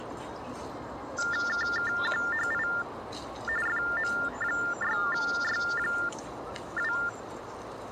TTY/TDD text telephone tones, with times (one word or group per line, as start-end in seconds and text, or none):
1.5-2.7 KKQHI
3.7-6.9 FM6Y2